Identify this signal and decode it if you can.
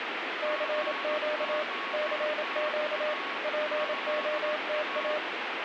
Morse code, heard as a keyed tone, machine-sent, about 27 wpm, 610 Hz, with radio static and a weaker station near 1110 Hz. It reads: CQ CQ POTA